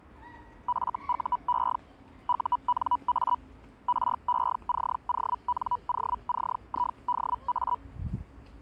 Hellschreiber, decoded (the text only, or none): FUE UNA RECONOCIDA